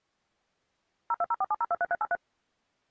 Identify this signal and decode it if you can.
DTMF, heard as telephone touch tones, dialled by machine, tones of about 40 ms. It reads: 02047023383